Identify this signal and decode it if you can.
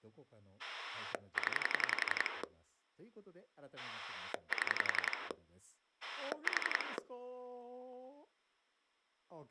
Pulse dialling, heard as a rotary dial, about 11 pulses a second, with speech in Japanese. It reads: 0 7 4